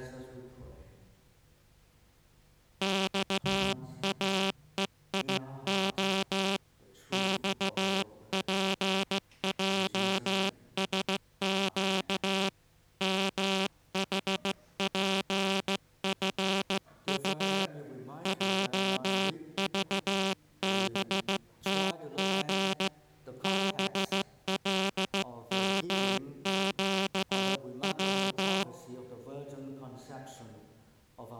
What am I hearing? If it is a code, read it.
Morse code, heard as a buzzer, hand-sent with a straight key, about 15 wpm. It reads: XAEIO XPJSQ MHPFU JVBTG BLMQW